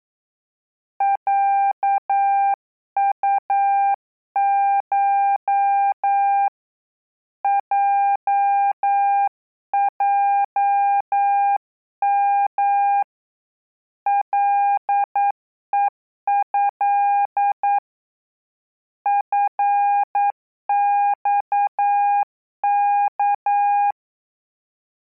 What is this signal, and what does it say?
Morse code (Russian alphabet), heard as a keyed tone, hand-sent with a paddle, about 9 wpm, 800 Hz. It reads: ЯУШ ЙЙМ ЛЕЭ ФЬК